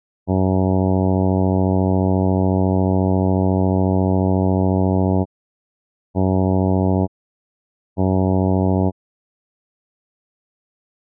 Ship horn signal, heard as a ship's horn, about 90 Hz. 1 long, 2 short. At sea: a vessel in fog that is sailing, fishing, towing or hampered.